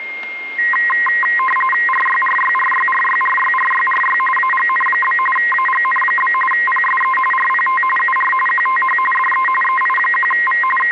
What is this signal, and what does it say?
RTTY (45.45 baud, 850 Hz shift), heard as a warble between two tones, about 1470 Hz centre, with static crashes and a steady whistle near 2120 Hz. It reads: RYRYRYRYRYRYRY AGN? AGN? PSE RPT UR QTH DE EI1V …